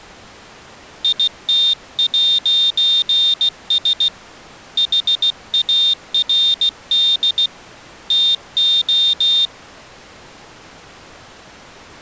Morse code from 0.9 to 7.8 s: IT'S HARD

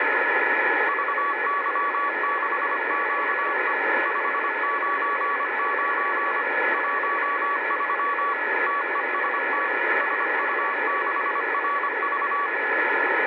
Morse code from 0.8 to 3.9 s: VY6QE

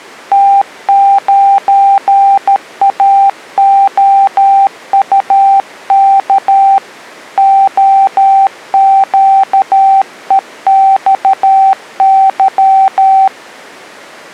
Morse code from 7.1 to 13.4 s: OQEXY

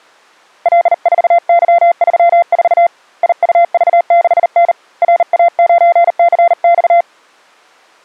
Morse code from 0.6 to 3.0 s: L4Y34

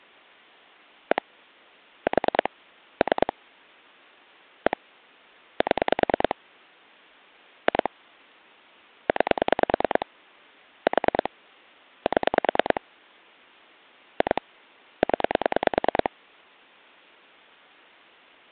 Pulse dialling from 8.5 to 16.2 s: 9 4 7 2 0

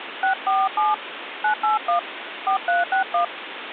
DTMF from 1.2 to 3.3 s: 981 4361

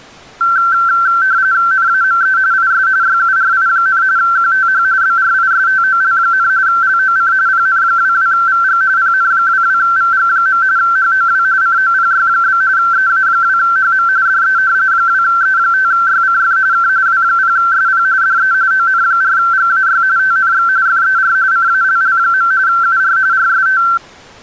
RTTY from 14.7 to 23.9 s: 2E5YCF K W0SP DE ON4GAY TNX FER CALL. UR RST

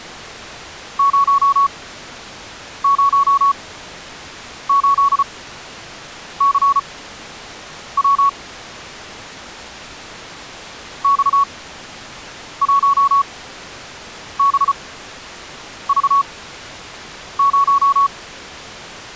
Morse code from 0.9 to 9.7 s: 008CW

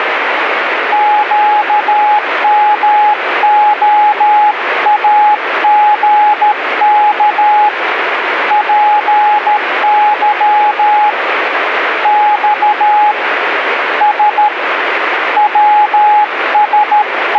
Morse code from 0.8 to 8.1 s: QMOAGK

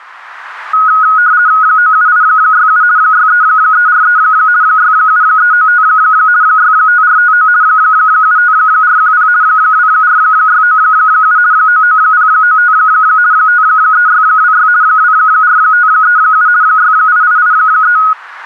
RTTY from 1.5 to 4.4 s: 97867 63343

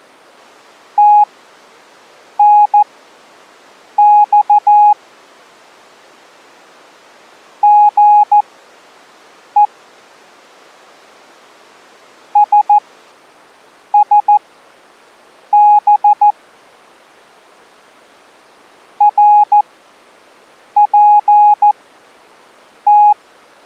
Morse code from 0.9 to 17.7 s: TNX GE SSB

